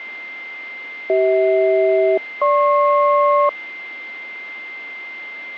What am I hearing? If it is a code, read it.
Aircraft SELCAL, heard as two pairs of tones, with a steady whistle near 2090 Hz. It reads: CH-GP